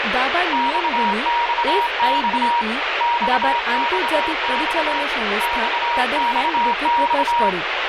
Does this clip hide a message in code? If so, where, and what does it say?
Yes: Morse code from 0.5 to 7.6 s, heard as a keyed tone, hand-sent with a straight key, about 26 wpm, 950 Hz, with heavy radio static and speech in Bangla. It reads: XXX XXX XXX